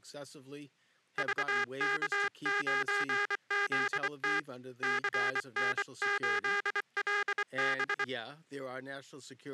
Morse code, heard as a buzzer, hand-sent with a paddle, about 24 wpm, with speech in English. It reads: VK9ZT CN8LB